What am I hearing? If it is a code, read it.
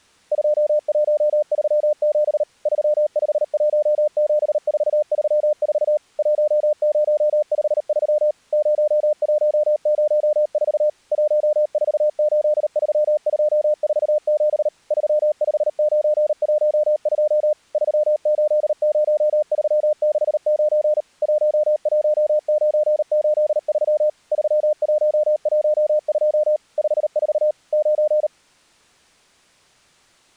Morse code, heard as a keyed tone, machine-sent, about 38 wpm, 600 Hz. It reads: 2137 3517434 1053 0104 1483247 35912 380369 11983 3112 54 9